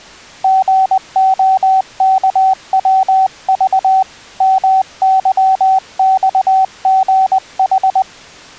Morse code, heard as a keyed tone, hand-sent with a paddle, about 20 wpm, 760 Hz. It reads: GOKWV MYXGH